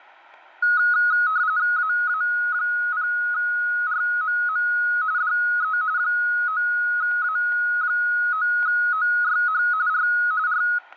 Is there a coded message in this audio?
Yes: RTTY (45.45 baud, 170 Hz shift) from 0.6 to 10.8 s, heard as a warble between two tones, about 1360 Hz centre, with static crashes and room echo. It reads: AA0RMM DE 9A9OYH R R